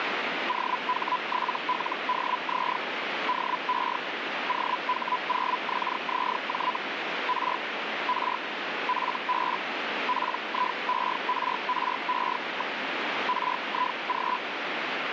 Hellschreiber (Feld-Hell, 122.5 baud), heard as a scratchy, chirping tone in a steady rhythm, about 1000 Hz, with radio static. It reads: OH7LDZ DE OH0XZJ R R FB PIERRE. RIG